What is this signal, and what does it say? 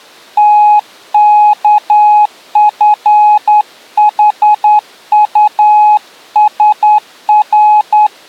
Morse code (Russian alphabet), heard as a keyed tone, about 10 wpm, 840 Hz. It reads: ТКФХУСР